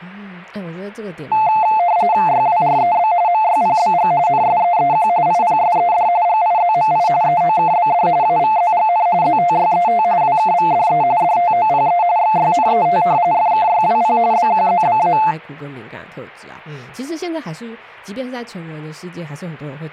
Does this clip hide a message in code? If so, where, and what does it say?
Yes: RTTY (45.45 baud, 170 Hz shift) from 1.3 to 15.3 s, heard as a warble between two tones, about 790 Hz centre, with speech in Chinese. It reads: YWREB MYPBG NSEEQ IPSED GIZMI EOKBD AVZGN ZTYET WKVDE DTOPE XYNET FKYWP BQZBA